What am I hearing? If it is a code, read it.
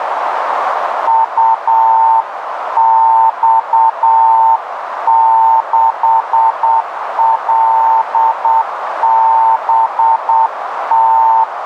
Morse code, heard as a keyed tone, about 8 wpm, 900 Hz, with radio static and a narrow filter. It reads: UX6LBT